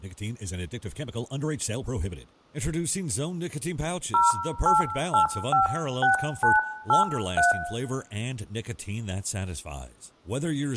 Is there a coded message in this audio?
Yes: DTMF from 4.1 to 7.5 s, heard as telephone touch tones, dialled by hand, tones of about 140 ms, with room echo and speech in English. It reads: 08856983